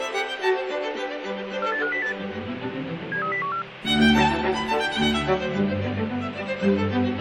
Five-tone selective call (CCIR), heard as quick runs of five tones, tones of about 100 ms, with radio hiss. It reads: 48508 73014